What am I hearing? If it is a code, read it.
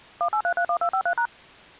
DTMF, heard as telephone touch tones, dialled by machine, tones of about 80 ms. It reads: 18331253#